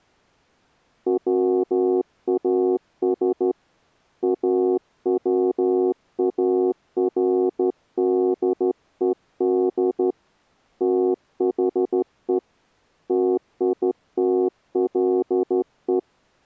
Morse code, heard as a keyed tone, hand-sent with a straight key, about 13 wpm, 370 Hz. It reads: WAS AWARDED THE TITLE